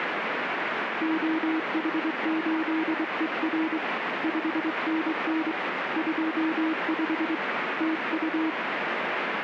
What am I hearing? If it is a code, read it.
Morse code, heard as a keyed tone, hand-sent with a straight key, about 23 wpm, 320 Hz, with radio static. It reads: OH8ER 5NN 25 TU